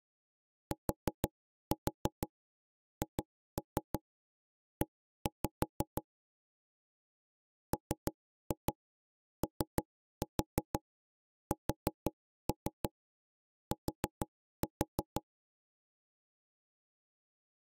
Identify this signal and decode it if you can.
Tap code, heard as knocks on wood, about 6 knocks a second. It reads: THE MOST